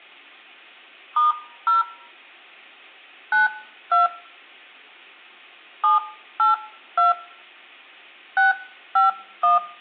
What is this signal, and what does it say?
DTMF, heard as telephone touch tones, dialled by hand, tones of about 150 ms, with room echo. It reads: *0 92 782 651